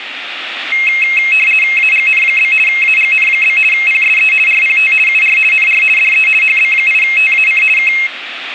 RTTY (50 baud, 450 Hz shift), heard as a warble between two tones, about 2350 Hz centre, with radio static. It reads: AGN? AGN? PSE RPT UR NR DE HB8TAC K